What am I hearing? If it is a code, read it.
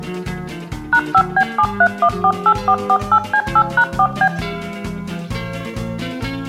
DTMF, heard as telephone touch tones, dialled by machine, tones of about 70 ms, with room echo. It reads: #5B73148448C8#4B